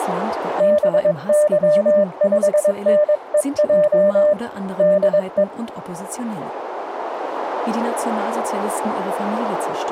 Morse code, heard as a keyed tone, hand-sent with a paddle, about 22 wpm, 600 Hz, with radio static and speech in German. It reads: BY5NEJ DE